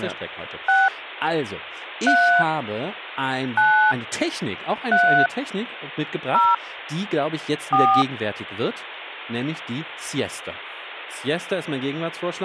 DTMF, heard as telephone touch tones, dialled by hand, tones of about 260 ms, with speech in German. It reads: 6 3 9 3 0 4